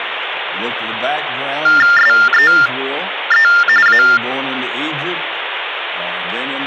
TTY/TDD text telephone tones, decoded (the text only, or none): SEE A